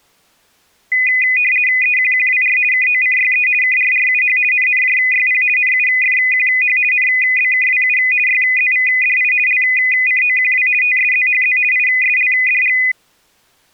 RTTY (50 baud, 450 Hz shift), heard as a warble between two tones, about 2250 Hz centre. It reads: EQQWR KOCYE KRRUH NNJYP NUFQH NBKWU YZVDI LCOQW TSZHZ ISLDG